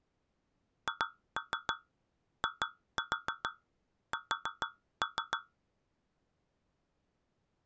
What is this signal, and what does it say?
Tap code, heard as taps on a metal pipe, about 6 knocks a second. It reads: HIS